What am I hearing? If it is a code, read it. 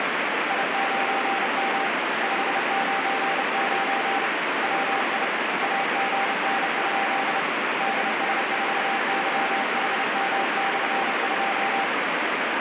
Morse code, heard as a keyed tone, hand-sent with a paddle, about 30 wpm, 790 Hz, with heavy radio static. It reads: I9M 599 WI AGN? DS4YHM/2